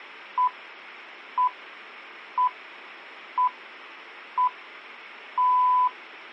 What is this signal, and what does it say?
Radio time signal (six pips, as the Greenwich Time Signal), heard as pips, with a squelch burst at the end.